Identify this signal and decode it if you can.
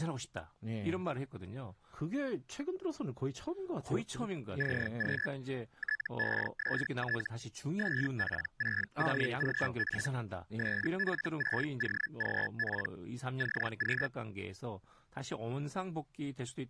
Hellschreiber (Feld-Hell, 122.5 baud), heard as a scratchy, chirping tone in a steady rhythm, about 1700 Hz, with speech in Korean. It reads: CQ TEST SP6OGP SP6OGP CQ